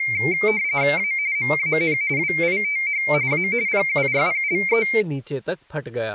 RTTY (45.45 baud, 170 Hz shift), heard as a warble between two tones, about 2200 Hz centre, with speech in Hindi. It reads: A MAN WITH A PURPLE